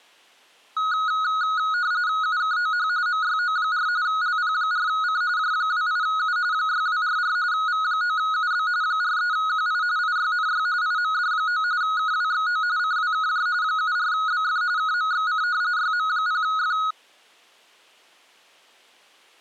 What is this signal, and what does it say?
RTTY (45.45 baud, 170 Hz shift), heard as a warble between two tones, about 1360 Hz centre. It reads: UKOH MYO4 LP4C J28U 6244 V9UB 43QI IYNY IMD9 KWXO CWKJ 74BF KMXC YM0F